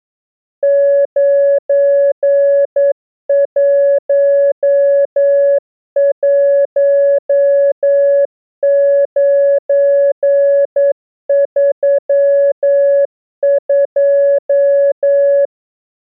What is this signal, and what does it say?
Morse code, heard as a keyed tone, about 9 wpm, 560 Hz. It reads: 911932